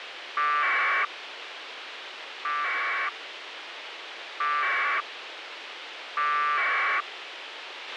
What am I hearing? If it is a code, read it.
Packet radio (AX.25, as in APRS), 1200 baud, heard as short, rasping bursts, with radio hiss and a squelch burst at the end.